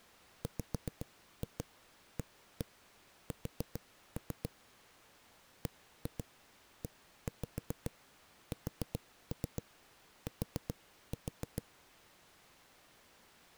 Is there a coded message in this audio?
Yes: tap code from 0.4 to 11.6 s, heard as knocks on a wall, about 7 knocks a second. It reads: WAS BEST